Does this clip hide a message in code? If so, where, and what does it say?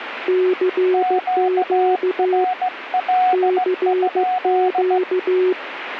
Yes: Morse code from 0.2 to 5.6 s, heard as two keyed tones, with radio static. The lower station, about 15 wpm, 370 Hz: CQ CQ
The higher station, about 17 wpm, 740 Hz: QRL?